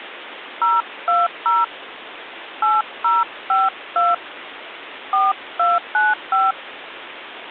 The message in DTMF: 020 8052 4295

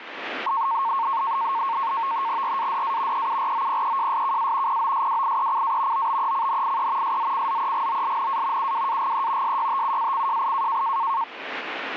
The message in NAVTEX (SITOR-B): RADA EUROPEJSKA POSWIECA OBECNIE SZCZEGOLNA UWAGE SYTUACJI

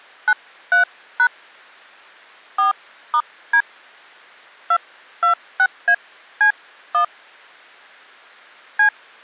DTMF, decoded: 93# 4*D 226AC1 C

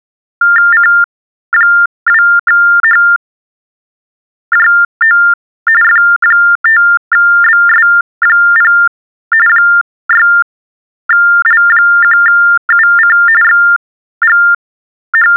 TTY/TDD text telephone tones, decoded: C2HJO F5BS0 6L1UC …

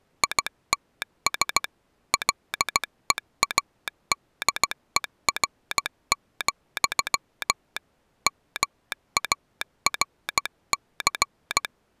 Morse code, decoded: ITS LEADER, MARC

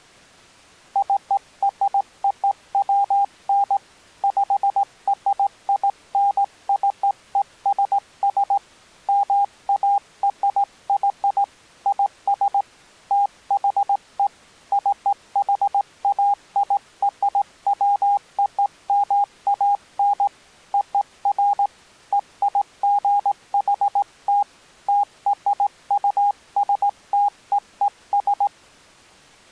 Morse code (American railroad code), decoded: CROWN PRINCESS MARY IS THE CHAIRWOMAN OF EIGHT TRUSTEES

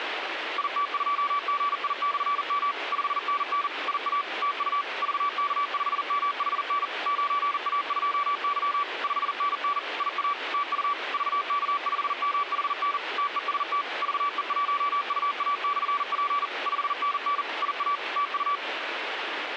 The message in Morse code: IT2GI/M 5NN IA TU VK5MHN 9A2Y 5NN IA TU VK5MHN TEST VE1UA/P 5NN IA TU

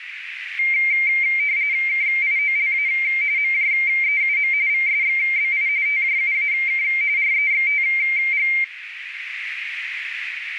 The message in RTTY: KIOLA MJEUM VSXBI TJUAK REXTG

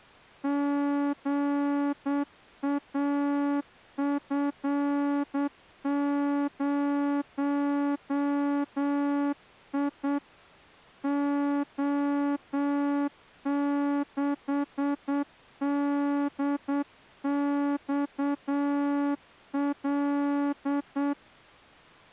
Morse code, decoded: GAF0I O6DXL

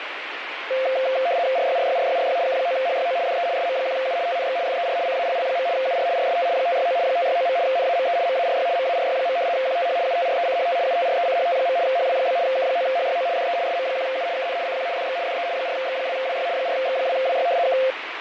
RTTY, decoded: RYRYRYRY K9HYO DE SM1U TNX FER CALL. UR RST 569 569. NAME MARY MARY. QTH UTRECHT UTRECHT. HW? K9HYO DE SM1U KN CQ DX DE 4X2WY 4X2WY K

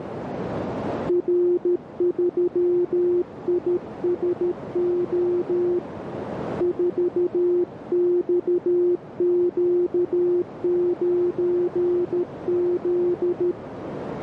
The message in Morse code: R3ISO 4XQ9Z

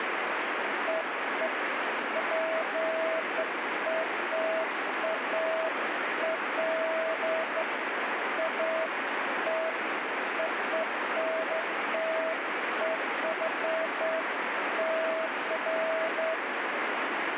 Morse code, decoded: none

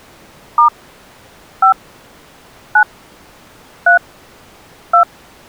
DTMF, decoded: * 5 9 3 2

